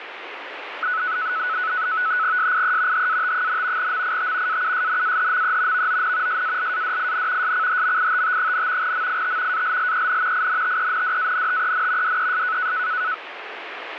NAVTEX (SITOR-B), 100 baud, 170 Hz shift, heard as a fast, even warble, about 1390 Hz centre, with radio static. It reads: SIE HAT, MIT AUSNAHME VON SALADIN SCHMITT, MIT ALLEN INTENDANTEN DES